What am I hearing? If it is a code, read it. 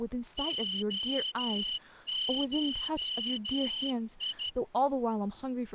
Morse code (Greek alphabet), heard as a whistle, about 13 wpm, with speech in English. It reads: ΟΧΙ